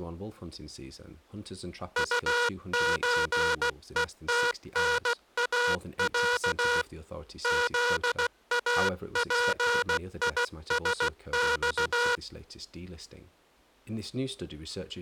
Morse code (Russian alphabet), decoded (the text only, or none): УЧЕТНАЯ ЗАПИСЬ